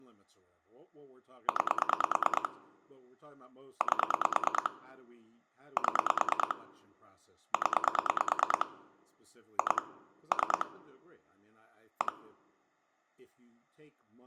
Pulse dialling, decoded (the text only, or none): 9 8 7 0 2 3 1